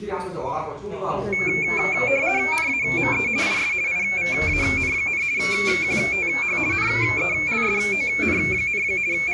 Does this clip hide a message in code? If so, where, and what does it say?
Yes: RTTY (50 baud, 170 Hz shift) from 1.3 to 9.3 s, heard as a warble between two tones, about 2300 Hz centre, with the noise of a restaurant. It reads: NAME IS IVAN, QTH NELSON, …